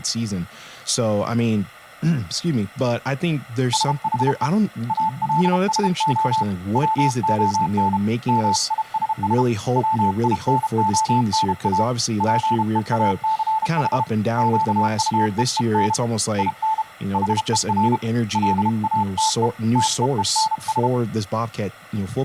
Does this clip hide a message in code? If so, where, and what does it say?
Yes: Morse code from 3.7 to 20.9 s, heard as a keyed tone, hand-sent with a paddle, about 32 wpm, 880 Hz, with speech in English. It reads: SHE ALSO WON MISS WINONA PEACH QUEEN IN HER LATE TEENS